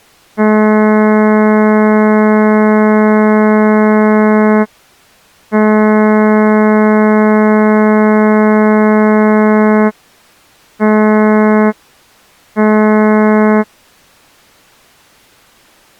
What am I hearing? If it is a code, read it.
Ship horn signal, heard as a ship's horn, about 210 Hz. 2 long, 2 short. At sea: I intend to overtake on your port side.